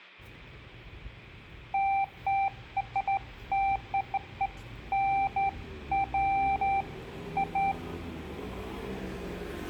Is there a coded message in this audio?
No, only beeps of irregular length, with hum, room echo and street noise.